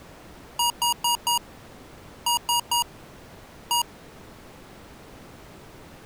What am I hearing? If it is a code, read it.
Beep code, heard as beeps from a small speaker, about 950 Hz. 4-3-1. In Phoenix BIOS tables: memory failure above the first 64 KB.